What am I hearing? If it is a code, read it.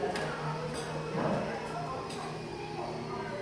The noise of a cafe. There is no code.